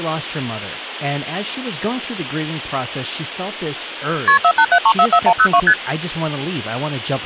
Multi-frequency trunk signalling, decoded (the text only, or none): KP 487344102 ST